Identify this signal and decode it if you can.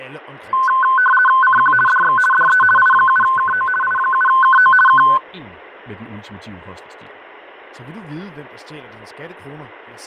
RTTY (50 baud, 450 Hz shift), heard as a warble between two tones, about 1280 Hz centre, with fading and speech in Danish. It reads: CQ DX DE I7KO I7KO K